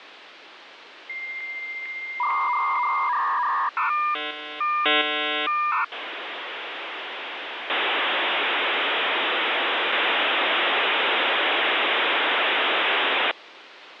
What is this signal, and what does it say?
Dial-up modem handshake (V.34 or later), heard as a whistle, warbles, then hiss, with phone line noise.